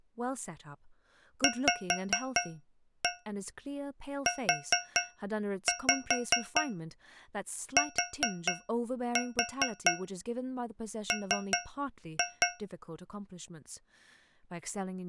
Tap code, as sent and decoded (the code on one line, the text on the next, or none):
5-1 4-5 4-4 3-2
VUTM